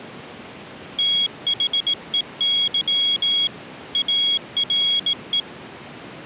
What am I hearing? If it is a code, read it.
Morse code, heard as a high beeper, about 18 wpm, 3300 Hz. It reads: THEY ARE